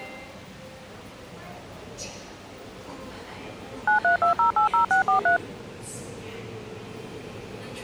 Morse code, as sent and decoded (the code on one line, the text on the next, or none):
none